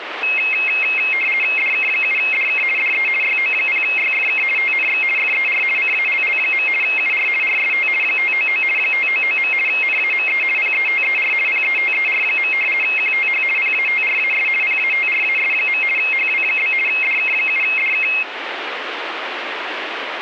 RTTY (50 baud, 450 Hz shift), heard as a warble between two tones, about 2350 Hz centre, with radio static. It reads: DK7DK DE YO0YFK TNX FER CALL. UR RST 599 599. NAME PETER PETER. QTH PATRAS PATRAS. HW? DK7DK